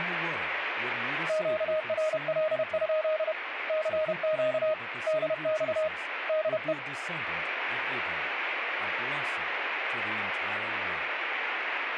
Morse code, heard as a keyed tone, hand-sent with a paddle, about 31 wpm, 620 Hz, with radio static and speech in English. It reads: QRL? CQ DX DE